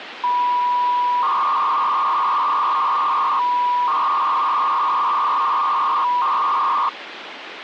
300-baud modem data (V.21 tones), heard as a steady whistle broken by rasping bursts, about 300 baud, 200 Hz shift, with phone line noise.